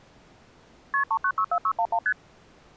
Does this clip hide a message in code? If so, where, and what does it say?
Yes: multi-frequency trunk signalling (R1, as on North American trunks) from 0.9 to 2.1 s, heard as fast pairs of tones, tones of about 70 ms. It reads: KP 3964611 ST